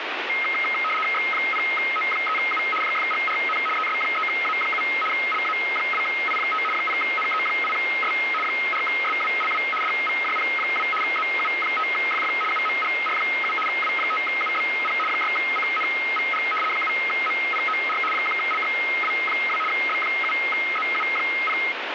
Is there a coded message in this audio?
Yes: RTTY (75 baud, 850 Hz shift) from 0.3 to 21.7 s, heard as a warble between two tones, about 1700 Hz centre, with radio static. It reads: X0O3U JFGRN ES3A7 LA2I5 0NE8S 4SWLW DVJP2 ZU5FF UMGR7 W5UBP 6CNVG 7MPOR 1LXW2 B7ZU0